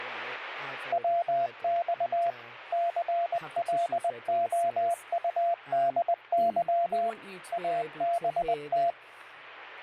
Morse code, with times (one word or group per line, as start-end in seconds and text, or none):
0.9-2.3 WX
2.7-7.1 CLOUDY
7.5-8.9 ABT